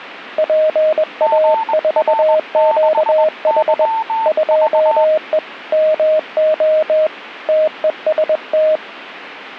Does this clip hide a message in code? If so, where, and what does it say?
Yes: Morse code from 0.3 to 8.8 s, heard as two keyed tones. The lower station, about 21 wpm, 620 Hz: PA4QH 2E MO TEST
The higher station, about 20 wpm, 890 Hz: GR6YV